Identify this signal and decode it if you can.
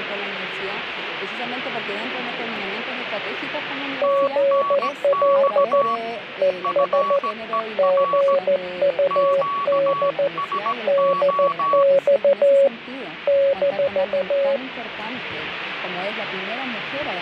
Morse code, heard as two keyed tones, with radio static. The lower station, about 14 wpm, 550 Hz: GL ES GUD DX -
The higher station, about 17 wpm, 1130 Hz: TNX FER QSO